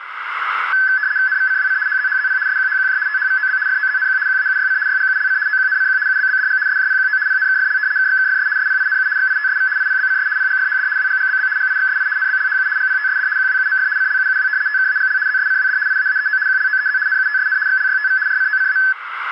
RTTY (75 baud, 170 Hz shift), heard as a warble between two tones, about 1600 Hz centre, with radio static and a narrow filter. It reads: NVCWC HZHZP SQHQJ THVOB FOZNQ QAUYC YGULC OQNCQ UBBDG SJPQO PNKFL KXKFS SPINU XITSV IPBCS PGFHD WGGBB GIXSI NBLHU GPTSD QWUMF CLUUW TKAGL ZSCWD IAAEO QLOEZ NUTSN XLYTV RCOCA